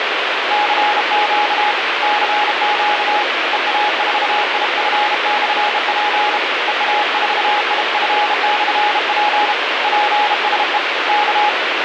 Morse code, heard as a keyed tone, hand-sent with a bug key, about 32 wpm, 840 Hz, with heavy radio static. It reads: CQ CQ EA4IF/P EA4IF/P PSE K